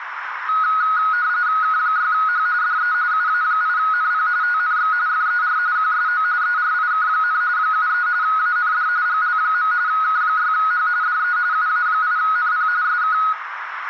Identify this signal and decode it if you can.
RTTY (45.45 baud, 170 Hz shift), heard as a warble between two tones, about 1360 Hz centre, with radio static, a narrow filter and room echo. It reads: K6H DE UA8NP TNX FER QSO ERIK, 73 AND GL. K6H DE UA8NP SK